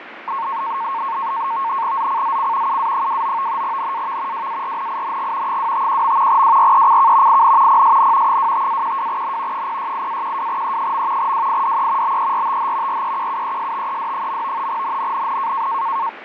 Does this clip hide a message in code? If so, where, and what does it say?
Yes: NAVTEX (SITOR-B), 100 baud, 170 Hz shift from 0.3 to 16.1 s, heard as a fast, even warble, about 1000 Hz centre, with radio static and fading. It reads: ZCZC UA29 NAV WARNING 251. WRECK IN PSN 25-12N 068-12E. WIDE BERTH REQUESTED. NNNN